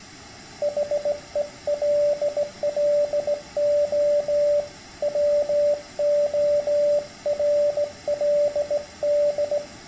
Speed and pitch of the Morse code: 17 wpm, 580 Hz

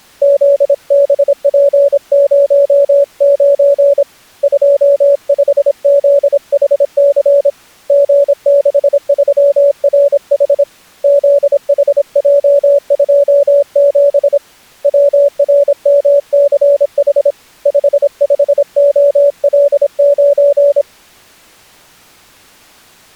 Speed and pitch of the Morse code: 26 wpm, 570 Hz

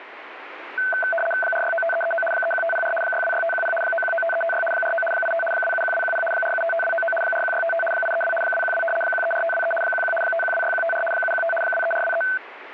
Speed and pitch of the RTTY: 75 baud, 850 Hz shift, 1090 Hz centre

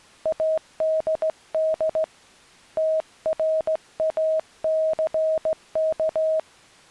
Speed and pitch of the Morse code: 16 wpm, 630 Hz

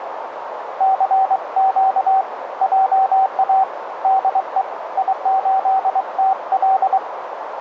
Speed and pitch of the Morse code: 23 wpm, 770 Hz

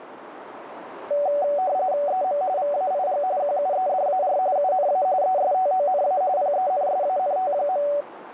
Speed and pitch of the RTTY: 45.45 baud, 170 Hz shift, 660 Hz centre

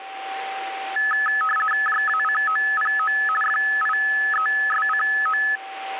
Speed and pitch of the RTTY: 50 baud, 450 Hz shift, 1500 Hz centre

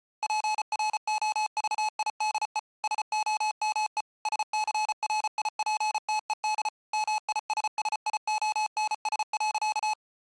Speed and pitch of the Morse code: 34 wpm, 860 Hz

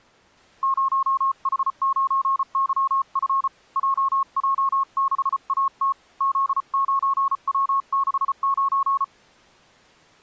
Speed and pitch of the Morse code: 34 wpm, 1090 Hz

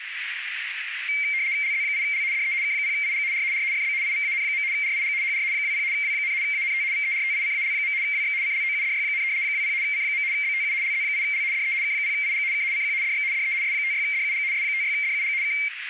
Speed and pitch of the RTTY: 75 baud, 170 Hz shift, 2200 Hz centre

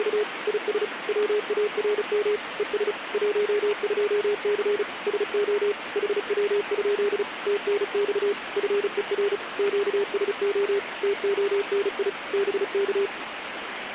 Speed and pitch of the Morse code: 35 wpm, 410 Hz

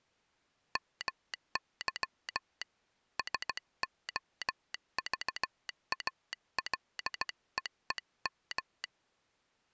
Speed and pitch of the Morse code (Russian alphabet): 16 wpm

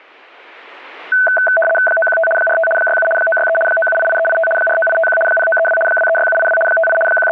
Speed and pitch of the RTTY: 75 baud, 850 Hz shift, 1080 Hz centre

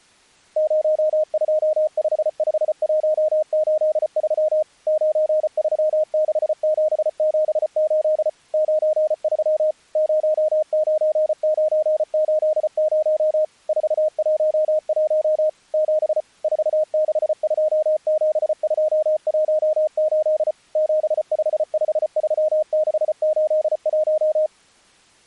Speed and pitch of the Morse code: 34 wpm, 620 Hz

